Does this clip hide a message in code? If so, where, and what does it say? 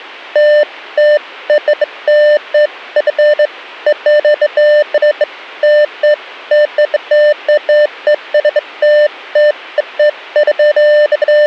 No, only beeps of irregular length.